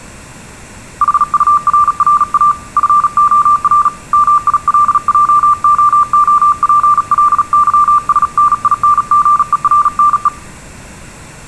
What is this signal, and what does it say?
Morse code, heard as a keyed tone, hand-sent with a paddle, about 37 wpm, 1180 Hz. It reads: HURRA FOR MILJOOPLYSNINGERNE